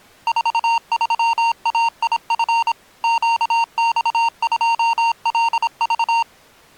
Morse code, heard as electronic beeps, machine-sent, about 26 wpm, 920 Hz. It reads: 43AIF QX2LV